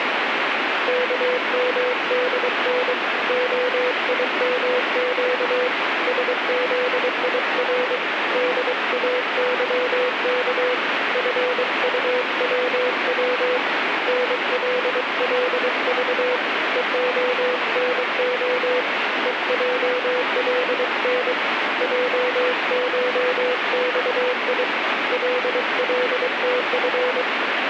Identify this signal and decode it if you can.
Morse code (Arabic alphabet), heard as a keyed tone, hand-sent with a paddle, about 23 wpm, 500 Hz, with radio static. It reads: كمدن خيمق سذير داظك فطوو نللض ءخنخ ءجلن جشصي للتف